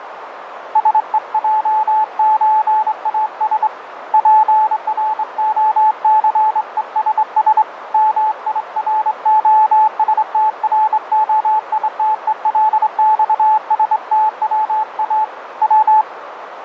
Morse code (Russian alphabet), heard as a keyed tone, hand-sent with a straight key, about 25 wpm, 870 Hz, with radio static and a narrow filter. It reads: СЕЙЧАС ПРОЦЕСС МИРОСТРОИТЕЛЬСТВА В